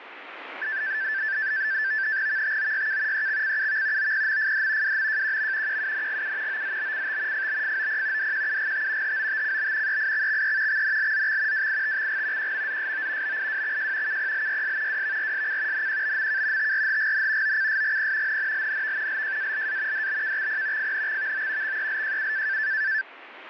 NAVTEX (SITOR-B), 100 baud, 170 Hz shift, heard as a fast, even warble, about 1650 Hz centre, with radio static. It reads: VTOYK EXCUV OPMFD WMJQM QUNGU OZBCT FBFOP DQUGT HOTCB EIXXE XNLZX WITXG QMZSO BIWXJ KPLYS WVRSC NQBMK TRHGN OCSGP NNLNV LJALA DBKXP FNXVO XELJU